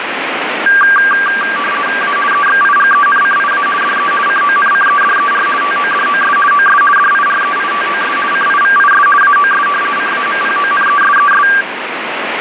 RTTY (50 baud, 450 Hz shift), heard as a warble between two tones, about 1380 Hz centre, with radio static. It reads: A EXIGENCIA DE CONCEDER TODOS OS DIREITOS CIVIS AOS CAMPONESES